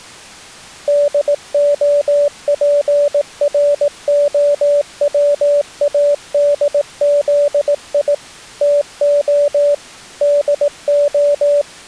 Morse code, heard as a keyed tone, machine-sent, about 18 wpm, 580 Hz. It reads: DOPROWADZI TO DO